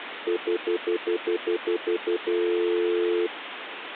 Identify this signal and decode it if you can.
Telephone call progress tone (North American plan), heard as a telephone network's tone, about 350, 440 Hz, 0.1 s on and 0.1 s off, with phone line noise. Stutter dial tone.